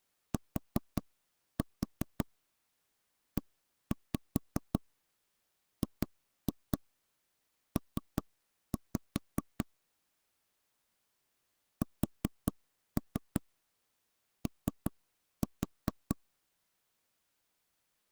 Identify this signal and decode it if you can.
Tap code, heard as knocks on wood, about 5 knocks a second. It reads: TEGP SO